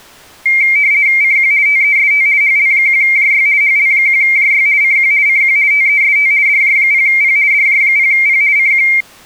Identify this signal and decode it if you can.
RTTY (50 baud, 170 Hz shift), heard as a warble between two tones, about 2200 Hz centre. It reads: CQ TEST HL1JY HL1JY CQ CQ TEST DJ0P DJ0P CQ